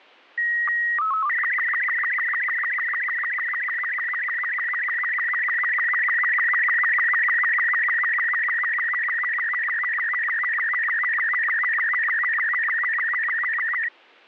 SSTV (slow-scan television), Robot 36, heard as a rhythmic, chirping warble.